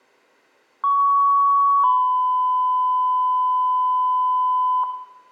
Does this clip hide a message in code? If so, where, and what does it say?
Yes: two-tone page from 0.8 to 4.8 s, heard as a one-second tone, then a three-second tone, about 1120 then 1010 Hz, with room echo.